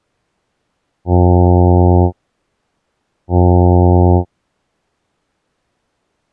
Ship horn signal, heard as a ship's horn, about 90 Hz. 2 short. At sea: I am altering course to port.